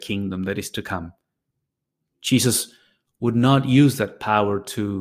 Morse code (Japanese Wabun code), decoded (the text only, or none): none